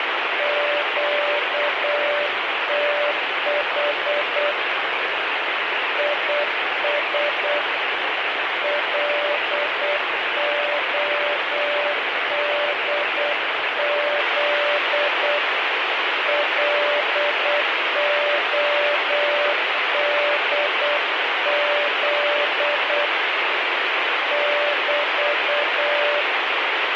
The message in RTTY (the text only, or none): none